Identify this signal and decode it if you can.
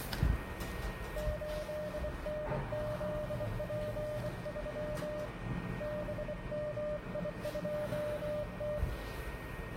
Morse code, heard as a keyed tone, hand-sent with a bug key, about 24 wpm, 600 Hz, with radio static, a steady whistle near 1860 Hz, room echo and the noise inside a lift. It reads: 8NZP3 BMI2T